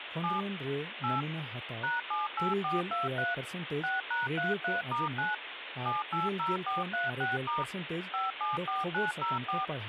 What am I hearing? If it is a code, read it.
DTMF, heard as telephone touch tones, dialled by machine, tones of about 160 ms, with phone line noise and speech in Santali. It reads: 7 8 #78423 6#33*9 780436* 574904